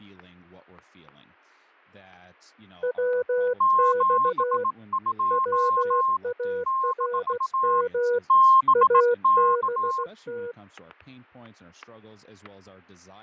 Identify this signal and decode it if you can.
Morse code, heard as two keyed tones, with fading, static crashes and speech in English. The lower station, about 16 wpm, 490 Hz: WX WARM ABT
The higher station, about 18 wpm, 1060 Hz: 72 - BK